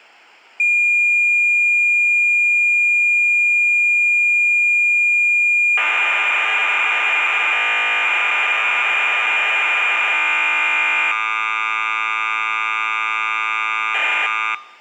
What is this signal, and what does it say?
Cassette data (Kansas City type), 1200 baud, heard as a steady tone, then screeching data.